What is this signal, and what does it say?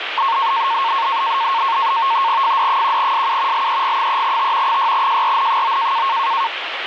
NAVTEX (SITOR-B), 100 baud, 170 Hz shift, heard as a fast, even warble, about 1000 Hz centre, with radio static. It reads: FD1SU LEG3T 6JRN9